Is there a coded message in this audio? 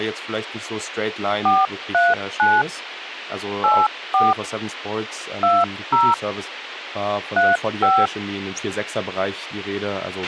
Yes: DTMF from 1.5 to 8.1 s, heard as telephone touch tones, dialled by hand, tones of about 200 ms, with radio hiss, a squelch burst at the end and speech in German. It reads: 439 84 20 35